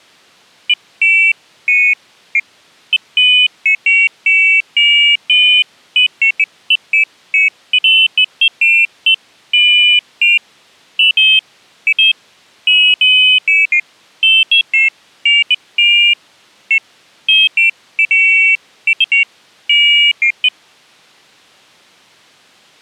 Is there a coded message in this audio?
No, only pairs of high tones at irregular times.